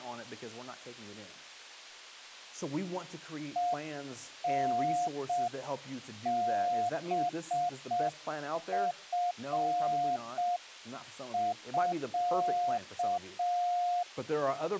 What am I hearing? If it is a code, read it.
Morse code (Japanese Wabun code), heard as a keyed tone, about 6 wpm, 710 Hz. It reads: ヘタハチミ